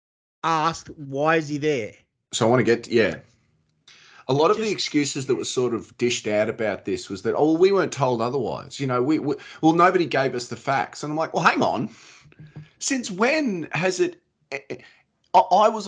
Speech in English. There is no code.